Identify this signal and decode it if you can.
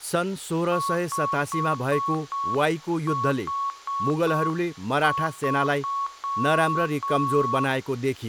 Morse code, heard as a keyed tone, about 6 wpm, 1110 Hz, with room echo and speech in Nepali. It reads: 5H3